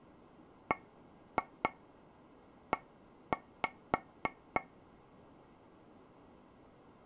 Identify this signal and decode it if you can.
Tap code, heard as taps on a table, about 3 knocks a second. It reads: BE